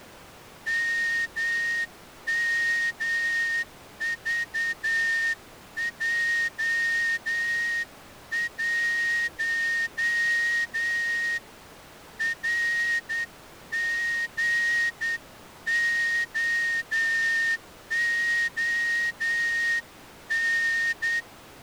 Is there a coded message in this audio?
Yes: Morse code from 0.6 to 21.3 s, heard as a whistle, hand-sent with a straight key, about 9 wpm. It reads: MMVJ1 RGOON